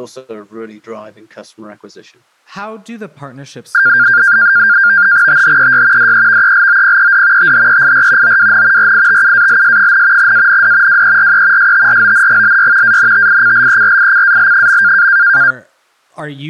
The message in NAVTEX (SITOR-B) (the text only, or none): THEY DEVELOPED THEIR OWN RITUALS, AND WERE STRONGLY ANTICLERICAL.